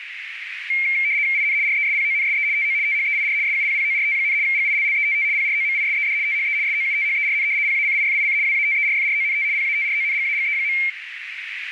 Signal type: RTTY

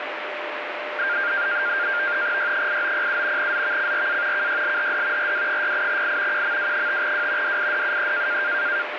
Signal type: NAVTEX (SITOR-B)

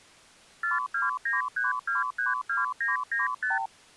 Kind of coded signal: multi-frequency trunk signalling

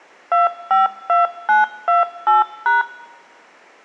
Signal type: DTMF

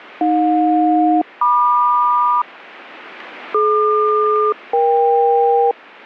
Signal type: aircraft SELCAL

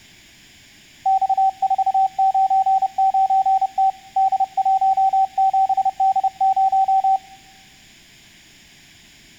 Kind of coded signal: Morse code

